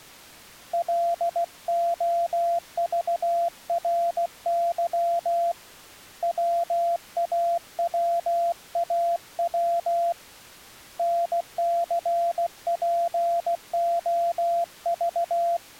Morse code, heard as a keyed tone, hand-sent with a paddle, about 16 wpm, 680 Hz. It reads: LOVRY WAWAW NCPOV